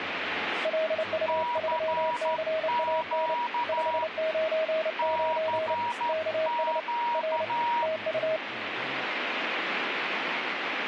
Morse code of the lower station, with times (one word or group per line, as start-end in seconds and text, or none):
0.7-3.3 LU3CAN
3.7-5.7 599
6.1-6.8 KS
7.1-7.4 R
7.8-8.4 TU